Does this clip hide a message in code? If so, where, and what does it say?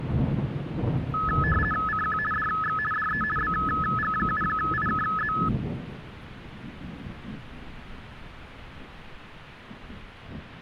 Yes: RTTY (50 baud, 450 Hz shift) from 1.1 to 5.5 s, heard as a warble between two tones, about 1500 Hz centre. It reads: CQ DX DE BG7IKZ